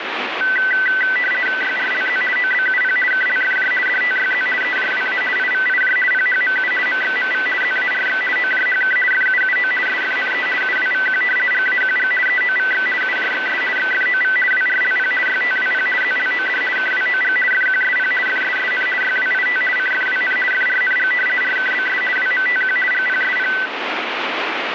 RTTY (50 baud, 450 Hz shift), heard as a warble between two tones, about 1750 Hz centre, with radio static. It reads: YRLZ OBUP KLFJ DTYZ EJWA IVIJ PHMU MXMV ZARX OJHK FUUO SFNE UWVQ GAQG EOVX UJXS XFOV WRLP YTWP ZLOD KWOG FQSP FSSN YWIT CFWN FRNG RKBS WMTQ GPSP